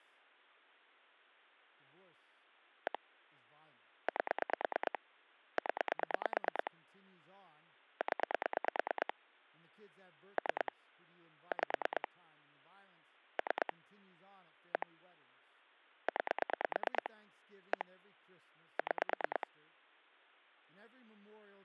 Pulse dialling, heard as clicks on a phone line, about 9 pulses a second, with speech in English. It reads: 1 8 0 0 3 5 3 1 9 1 6